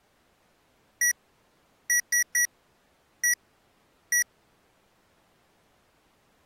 Beep code, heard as beeps from a small speaker, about 1950 Hz. 1-3-1-1. In Phoenix BIOS tables: memory refresh test failure.